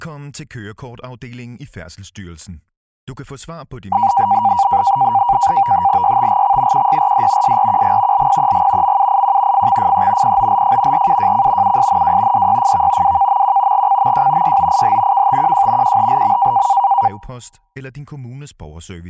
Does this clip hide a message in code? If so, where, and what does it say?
Yes: NAVTEX (SITOR-B), 100 baud, 170 Hz shift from 3.9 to 17.1 s, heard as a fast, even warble, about 870 Hz centre. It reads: YTGX QYRD SRQG LPEG MUIQ FXFE POLF RUJC USNW DYFV WKMQ GCMJ YOIH KTQJ QHLM